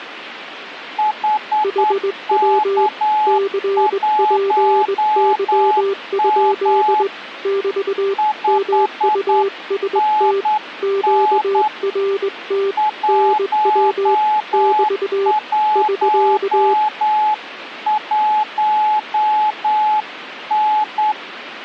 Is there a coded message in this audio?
Yes: Morse code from 0.9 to 21.2 s, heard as two keyed tones, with radio static. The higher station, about 9 wpm, 850 Hz: HK1M 5NN 111N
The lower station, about 20 wpm, 390 Hz: HW CPY? <BT> MUST QRT NW <BT> <SK>